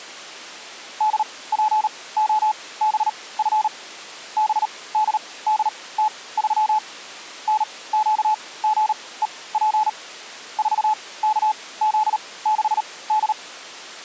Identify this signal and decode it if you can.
Morse code, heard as a keyed tone, machine-sent, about 38 wpm, spaced as for 21 wpm, 860 Hz. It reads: DPOBF BDDT3 NQGEP 4KZ6D